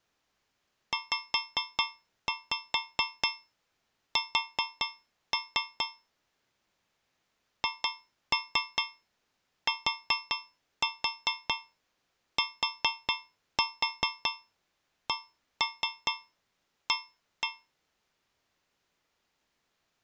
Tap code, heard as taps on a metal pipe, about 4 knocks a second. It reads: ZS HTTCA